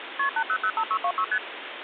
Multi-frequency trunk signalling (R1, as on North American trunks), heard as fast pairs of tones, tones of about 70 ms, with phone line noise. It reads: KP 8005626 ST